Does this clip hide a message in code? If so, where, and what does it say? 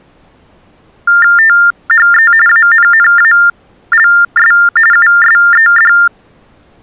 Yes: TTY/TDD text telephone tones (45.45 baud Baudot) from 1.1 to 6.1 s, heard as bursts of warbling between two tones, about 400 Hz shift, 1600 Hz centre. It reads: THE ANNALS USED